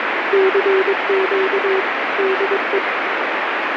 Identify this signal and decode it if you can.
Morse code, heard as a keyed tone, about 22 wpm, 380 Hz, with heavy radio static. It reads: CQ DE